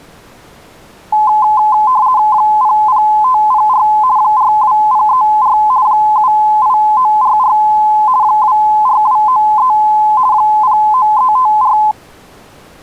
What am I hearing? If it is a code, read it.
RTTY (50 baud, 170 Hz shift), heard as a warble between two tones, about 940 Hz centre. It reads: 00504 42034 78944 24293 09354